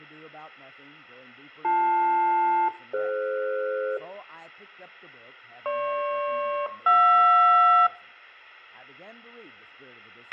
Aircraft SELCAL, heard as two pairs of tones, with a squelch burst at the end and room echo. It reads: BL-DF GP-JR